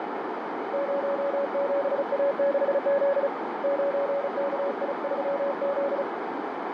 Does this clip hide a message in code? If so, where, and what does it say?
Yes: Morse code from 0.7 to 6.1 s, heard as a keyed tone, hand-sent with a paddle, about 35 wpm, 560 Hz, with radio static and a narrow filter. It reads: 07A6Z 9KI3Z